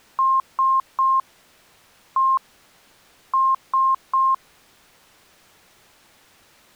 Beep code, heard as beeps, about 1060 Hz. 3-1-3. In Phoenix BIOS tables: interrupt mask register failure.